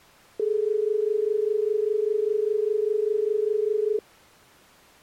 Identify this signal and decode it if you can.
Telephone call progress tone (as in Australia), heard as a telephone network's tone, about 430 Hz. Dial tone.